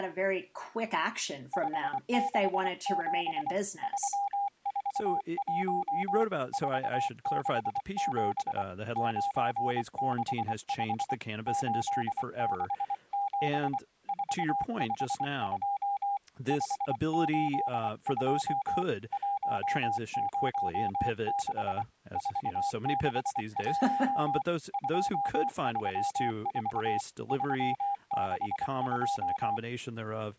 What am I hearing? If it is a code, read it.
Morse code, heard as a keyed tone, hand-sent with a paddle, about 24 wpm, 800 Hz, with speech in English. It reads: 567 341 467 965 867 452 582 106 461 234 362